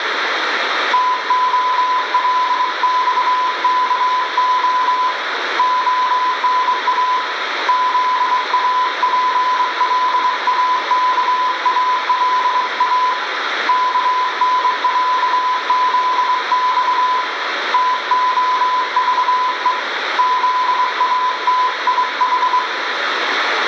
Morse code (Russian alphabet), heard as a keyed tone, hand-sent with a straight key, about 23 wpm, 1000 Hz, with radio static and room echo. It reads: ТОЛЬКО ОНА ЗАПЛАКАЛА КНЯЗЬ ТОЖЕ ЗАТИХ